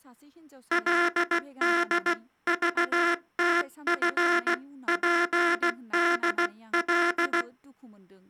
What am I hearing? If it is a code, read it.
Morse code (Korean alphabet), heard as a buzzer, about 16 wpm, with speech in Bodo. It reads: 그런즉